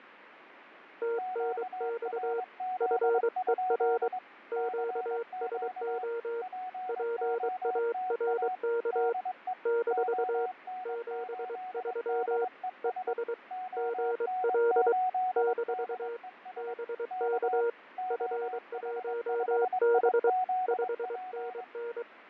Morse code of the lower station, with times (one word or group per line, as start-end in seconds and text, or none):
1.0-2.4 TNX
2.8-4.1 FER
4.5-6.4 QSO
6.9-9.1 PARK
9.7-10.5 -
10.9-12.4 73
12.8-13.3 ES
13.8-14.9 GL
15.4-16.2 -
16.6-17.7 BK
18.1-20.3 F1B
20.7-22.0 5NN